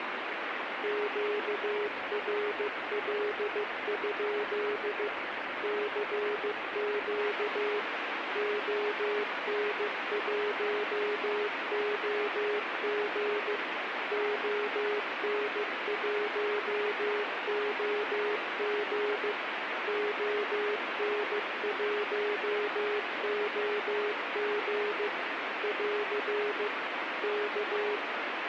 Morse code, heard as a keyed tone, machine-sent, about 15 wpm, 420 Hz, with radio static. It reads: QRL? CQ ON1OG ON1OG ON1OG <AR> K